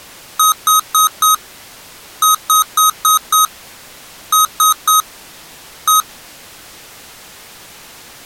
Beep code, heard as beeps from a small speaker, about 1260 Hz. 4-5-3-1.